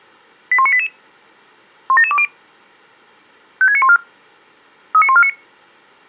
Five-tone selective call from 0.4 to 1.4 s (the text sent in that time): 81988